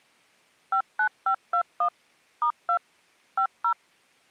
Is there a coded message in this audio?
Yes: DTMF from 0.7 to 3.7 s, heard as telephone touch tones, dialled by machine, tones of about 80 ms. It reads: 59521 *2 50